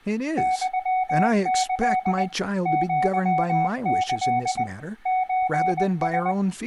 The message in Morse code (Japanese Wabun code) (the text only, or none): ユキ アキ ソラ